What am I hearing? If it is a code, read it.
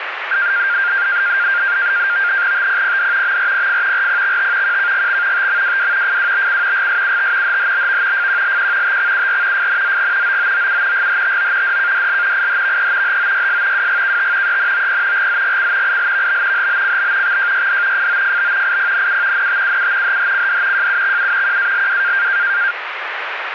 NAVTEX (SITOR-B), 100 baud, 170 Hz shift, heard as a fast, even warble, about 1500 Hz centre, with radio static. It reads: TPPD MRPF RPXT QKGX TMWW FWBC GSUT HHBV FQLQ TXUR FNZG OOOU GHTO DKDL IHVE HOYS WGKT ENOP GZGC ILVB HBCB XJYD FOFB IPNU NTUU HHCD JUXU QALW